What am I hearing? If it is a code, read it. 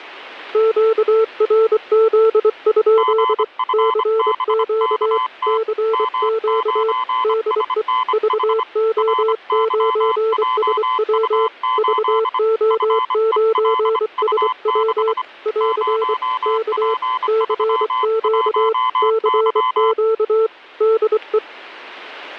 Morse code, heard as two keyed tones, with radio static. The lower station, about 24 wpm, 440 Hz: QRZ? CQ CQ DE VO9SW VO9SW <AR> K CQ CQ DE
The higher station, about 25 wpm, 1020 Hz: GFBKT M9SNH RYJU8 FELU6 0P31Y